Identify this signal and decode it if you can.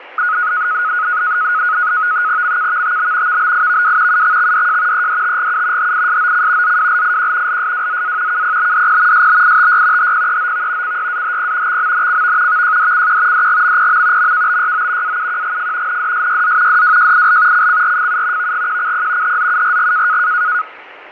NAVTEX (SITOR-B), 100 baud, 170 Hz shift, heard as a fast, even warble, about 1360 Hz centre, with radio static and fading. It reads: MKVTB VBIVW UXXDJ EDTGU HISOC ZWLIQ LSWZA KPBDP SBITY HPEOV CYAHP XMNCV VJDCQ DGMPM MKBYO AUQGF NDSYZ DWJIL CCRFU VGQCP HZURG